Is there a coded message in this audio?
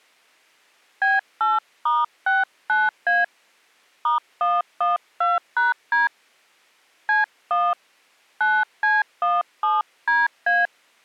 Yes: DTMF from 1.0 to 10.7 s, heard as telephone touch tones, dialled by hand, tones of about 180 ms. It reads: B8*69A *112#D C1 9C17DA